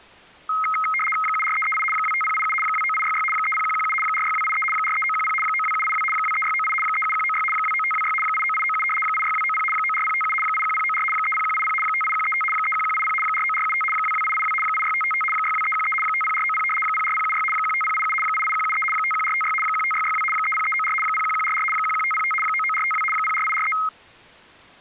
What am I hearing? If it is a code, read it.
RTTY (75 baud, 850 Hz shift), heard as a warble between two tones, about 1700 Hz centre. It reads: 74338 25087 29866 30117 46283 43910 92782 23698 37196 29526 89897 86290 94057 81094 30180 58135 31180 49475 22882 86555 62313 50490 04076 15087 88173 51456 15662 30394 01144 11505 99452 04843